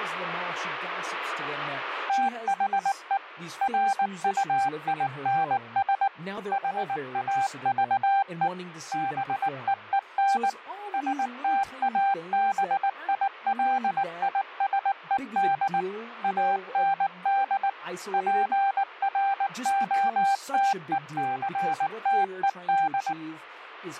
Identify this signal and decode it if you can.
Morse code, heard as a keyed tone, machine-sent, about 19 wpm, 790 Hz, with radio static and speech in English. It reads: THE RUINS HAVE BEEN STABILISED AND PROTECTED